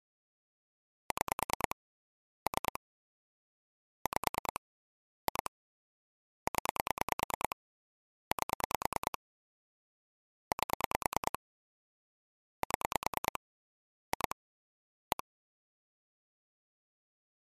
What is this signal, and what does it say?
Pulse dialling, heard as clicks on a phone line, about 9 pulses a second. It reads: 6 3 5 2 0 8 8 7 2 1